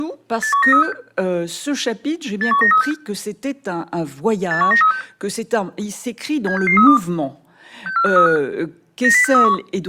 Five-tone selective call (CCIR), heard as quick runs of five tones, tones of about 100 ms, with speech in French. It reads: 81936 81936 81936 76632 64535 90631